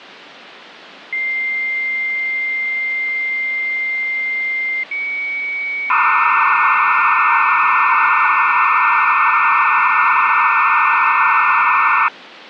Dial-up modem handshake (low-speed, two carriers), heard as two whistles, then hiss.